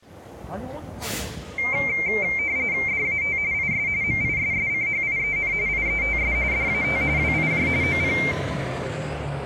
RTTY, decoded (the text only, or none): DAT IS MISSCHIEN IETS DAT WIJ OP